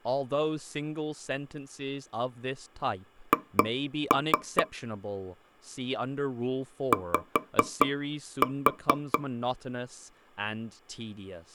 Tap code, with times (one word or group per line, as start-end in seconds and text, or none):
3.3-4.6 H
6.9-9.2 Y